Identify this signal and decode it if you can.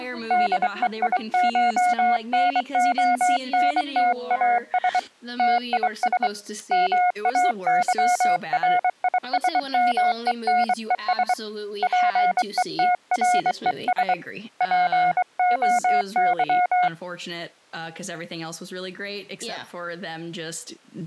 Morse code (Greek alphabet), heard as a keyed tone, hand-sent with a straight key, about 23 wpm, 720 Hz. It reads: ΔΕΙΧΝΟΝΤΑΣ ΤΙΣ ΜΑΥΡΙΣΜΕΝΕΣ ΠΕΤΡΕΣ ΠΟΥ